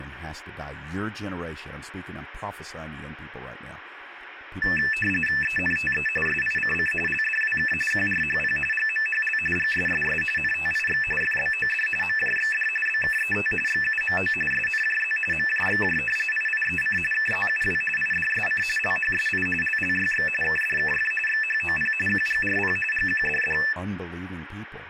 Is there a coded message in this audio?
Yes: RTTY (45.45 baud, 850 Hz shift) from 4.6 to 23.7 s, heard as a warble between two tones, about 2200 Hz centre, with radio static and speech in English. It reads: ENTE SICC LDWK QRHP GMHL GSSS NTIX FBOD MJXD BKET XUMO SNJZ MJXJ IIEC KZUW IDSC LHSI LLYX KDKF XHOP QGRP GQDD